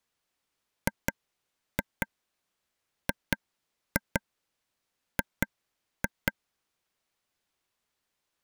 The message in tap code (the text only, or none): GGG